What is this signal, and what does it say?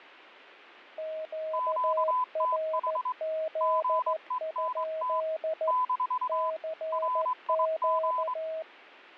Morse code, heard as two keyed tones. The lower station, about 14 wpm, 640 Hz: QRZ? CQ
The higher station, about 23 wpm, 1010 Hz: QTH GENT - RIG